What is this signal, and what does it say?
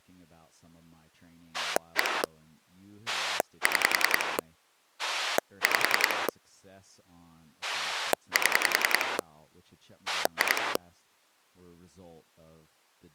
Pulse dialling, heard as a rotary dial, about 10 pulses a second, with speech in English. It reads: 1 6 5 7 2